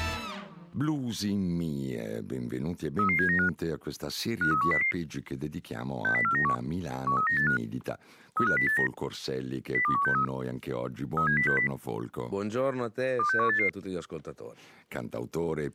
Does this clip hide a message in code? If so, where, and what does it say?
Yes: five-tone selective call (CCIR) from 3.0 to 13.7 s, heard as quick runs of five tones, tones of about 100 ms. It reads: 33795 53100 60491 13985 35089 02163 37060 26188